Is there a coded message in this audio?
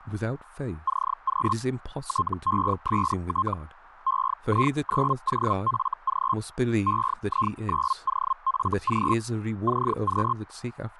Yes: Hellschreiber (Feld-Hell, 122.5 baud) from 0.9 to 10.3 s, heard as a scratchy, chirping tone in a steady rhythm, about 1060 Hz, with speech in English. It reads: CQ TEST EI9OFG EI9OFG CQ